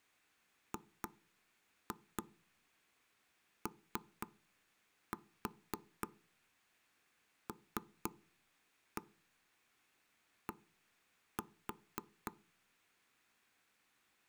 Tap code, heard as taps on a table, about 3 knocks a second. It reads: GOLD